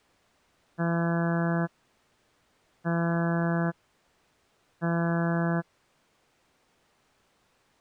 Ship horn signal, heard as a ship's horn, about 170 Hz. 3 short. At sea: I am operating astern propulsion.